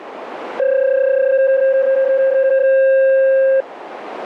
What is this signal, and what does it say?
PSK31 (31.25 baud), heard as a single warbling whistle, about 530 Hz, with radio static.